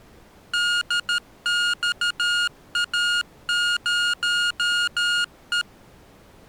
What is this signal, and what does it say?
Morse code, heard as electronic beeps, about 13 wpm, 1430 Hz. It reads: DXA0E